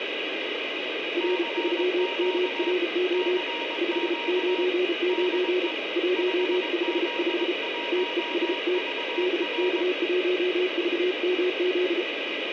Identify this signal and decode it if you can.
Morse code, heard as two keyed tones, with heavy radio static. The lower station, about 33 wpm, 360 Hz: R3MRO 599 155 TEST DK1VMZ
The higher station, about 21 wpm, 940 Hz: CQ CQ DE 5Z1VR